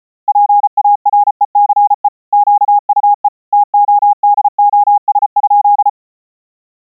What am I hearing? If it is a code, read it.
Morse code, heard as a keyed tone, machine-sent, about 34 wpm, 820 Hz. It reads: PARECE QUE TODOS?